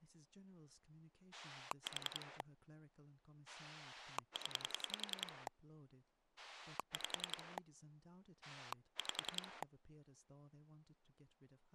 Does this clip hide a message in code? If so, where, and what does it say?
Yes: pulse dialling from 1.3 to 9.6 s, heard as a rotary dial, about 10 pulses a second, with speech in English. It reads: 4 0 5 5